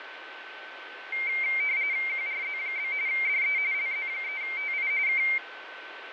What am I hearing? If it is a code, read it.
RTTY (45.45 baud, 170 Hz shift), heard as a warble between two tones, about 2200 Hz centre, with radio static, fading and a steady whistle near 1530 Hz. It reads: QRZ? DE LZ3TI K